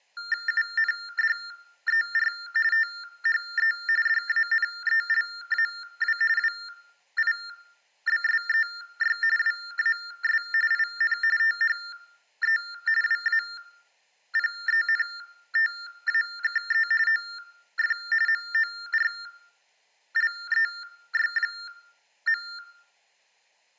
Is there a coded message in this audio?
Yes: TTY/TDD text telephone tones (45.45 baud Baudot) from 0.2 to 22.6 s, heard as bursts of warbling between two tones, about 400 Hz shift, 1600 Hz centre. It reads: UNDER THE DANELAW WIBSEY WAS IN THE WAPENTAKE OF MORLEY.